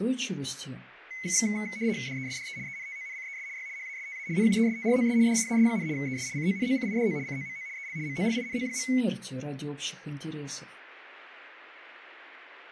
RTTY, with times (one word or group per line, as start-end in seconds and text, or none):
2.1-2.6 DESDE
2.7-3.5 ENTONCES
3.6-3.7 Y
3.8-4.3 HASTA
4.4-5.2 NUESTROS
5.3-5.9 DIAS,
6.0-6.3 ES
6.4-7.2 CONOCIDO
7.3-7.7 COMO
7.8-8.0 EL
8.1-8.9 MOLINO.